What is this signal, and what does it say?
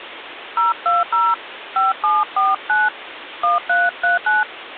DTMF, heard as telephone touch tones, dialled by hand, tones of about 190 ms, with phone line noise. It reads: 020 5749 1339